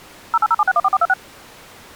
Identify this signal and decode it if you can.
DTMF, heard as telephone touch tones, dialled by machine, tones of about 40 ms. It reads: 0807614426